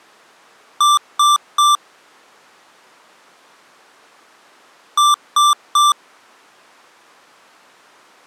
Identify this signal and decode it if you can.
Beep code, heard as beeps from a small speaker, played twice, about 1180 Hz. 3 short. In AMI BIOS tables: failure in the first 64 KB of memory; in Dell tables: chipset error.